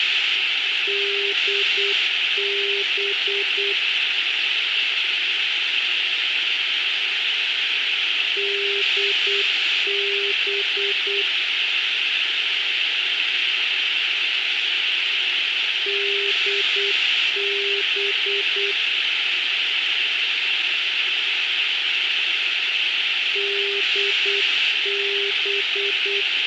Morse code, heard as a keyed tone, machine-sent, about 8 wpm, 400 Hz, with radio hiss. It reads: DB DB DB DB